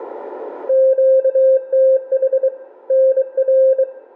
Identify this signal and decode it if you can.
Morse code, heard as a keyed tone, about 23 wpm, 530 Hz, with room echo. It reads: QTH NR